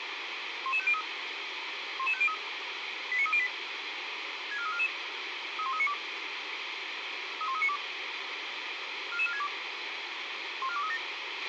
Five-tone selective call (ZVEI), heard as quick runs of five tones, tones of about 70 ms, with radio hiss and a squelch burst at the end. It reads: 11503 11503 89308 64344 31392 31392 44462 14237